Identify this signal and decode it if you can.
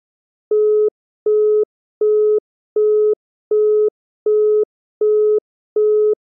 Telephone call progress tone (as in the UK, Australia and similar networks), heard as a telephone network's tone, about 420 Hz, 0.375 s on and 0.375 s off. Busy tone.